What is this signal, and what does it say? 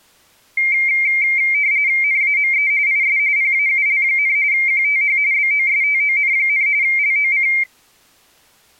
RTTY (45.45 baud, 170 Hz shift), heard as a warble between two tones, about 2200 Hz centre. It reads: NAME IS PAUL, QTH BOSTON, LOC